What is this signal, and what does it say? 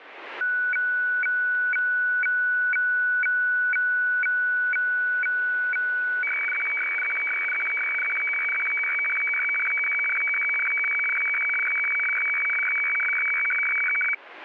Weather fax (radiofax), 120 lines a minute, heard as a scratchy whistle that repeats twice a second, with radio static.